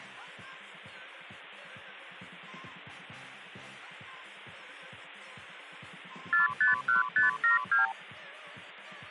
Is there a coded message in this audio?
Yes: multi-frequency trunk signalling (R2, with the far end's replies) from 6.3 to 7.9 s, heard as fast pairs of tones, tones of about 140 ms. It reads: 451572